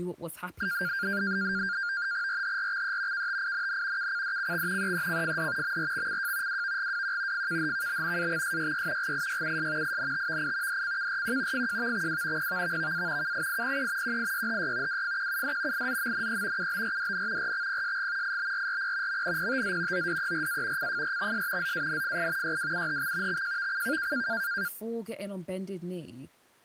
NAVTEX (SITOR-B), 100 baud, 170 Hz shift, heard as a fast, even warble, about 1500 Hz centre, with speech in English. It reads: RHRXE KTINN KCDCX EECFD MRXCJ WVGWQ FKHKB AXSYY GIYUS INTVI DCKRQ FJVXW PVVVA KIIPE QIYHY WFQUD IZMNE UBRDN RXPSG IBRRP MNPTZ ODERA CFRXS ZANFI YWUHX XJVCK